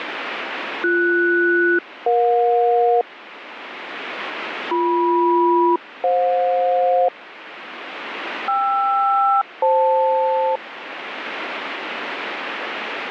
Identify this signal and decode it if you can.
Aircraft SELCAL, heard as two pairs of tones, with radio static. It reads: BS-EJ BM-FJ KR-FL